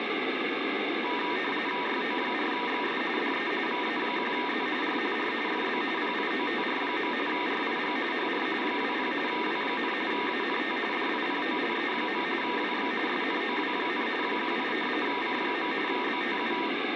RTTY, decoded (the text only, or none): YO4XS DE VA1Z R R FB PIOTR. RIG HR 20 W, ANT DIPOLE. WX SNOW, 18 C. BTU